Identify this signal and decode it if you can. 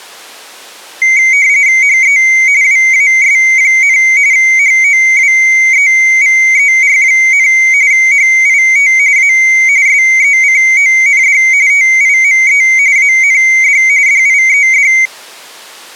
RTTY (45.45 baud, 170 Hz shift), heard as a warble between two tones, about 2150 Hz centre. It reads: HE WAS, HOWEVER, HIT A SECOND TIME AND DIED